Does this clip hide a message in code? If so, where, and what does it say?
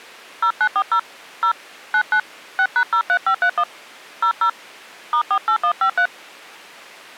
Yes: DTMF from 0.4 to 6.1 s, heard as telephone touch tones, dialled by hand, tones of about 80 ms. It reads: 0940 0 99 6#03531 00 *48153